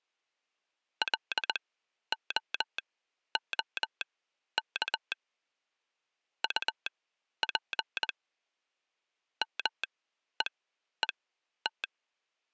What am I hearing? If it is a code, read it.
Morse code, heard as a telegraph sounder, machine-sent, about 20 wpm, spaced as for 11 wpm. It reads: LOOK UP MEET